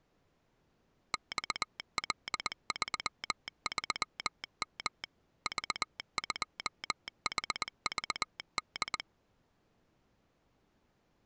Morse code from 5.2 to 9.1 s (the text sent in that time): V2HVD